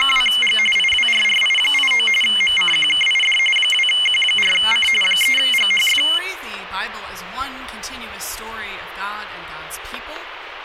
RTTY (45.45 baud, 850 Hz shift), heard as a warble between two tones, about 2550 Hz centre. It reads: … IWRRI89 MCQKID 2Q4C 3GHF